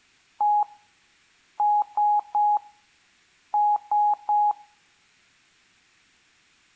Beep code, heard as beeps, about 830 Hz. 1-3-3. In Phoenix BIOS tables: chip or data line failure in the first 64 KB of memory.